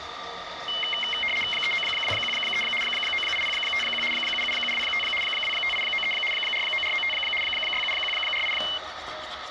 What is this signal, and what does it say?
RTTY (75 baud, 850 Hz shift), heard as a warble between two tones, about 2550 Hz centre, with static crashes and the noise of a restroom. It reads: 39213 98051 77725 25893 49495 67148